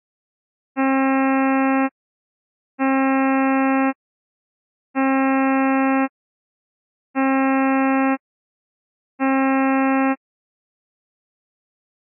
Ship horn signal, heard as a ship's horn, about 270 Hz. 5 short. At sea: I doubt that you are doing enough to avoid a collision.